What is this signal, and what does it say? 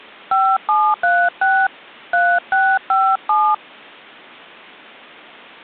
DTMF, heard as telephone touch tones, dialled by hand, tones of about 260 ms. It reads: 5736 3657